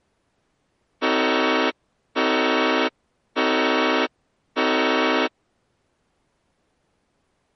Train horn signal, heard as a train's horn. 4 short. On North American railways: a request for a signal to be given or repeated.